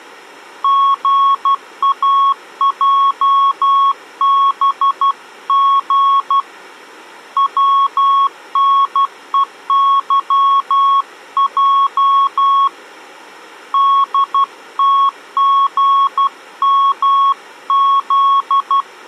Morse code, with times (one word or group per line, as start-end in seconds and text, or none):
0.6-6.4 GAJBG
7.4-12.7 WNEYJ
13.7-18.8 DTGMZ